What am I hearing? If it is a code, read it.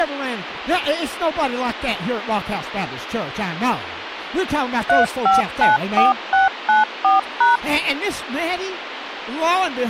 DTMF, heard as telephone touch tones, dialled by machine, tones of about 150 ms, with phone line noise and speech in English. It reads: 3594694#